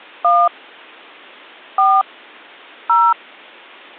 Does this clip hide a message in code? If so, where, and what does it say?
Yes: DTMF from 0.2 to 3.1 s, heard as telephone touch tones, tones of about 230 ms. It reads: 1 4 0